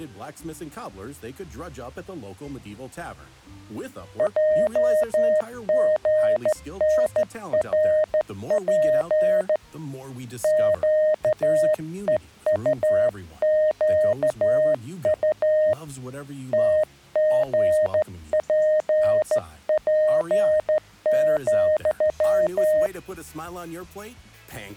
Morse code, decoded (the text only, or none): JGNRP QEUQU TGPP,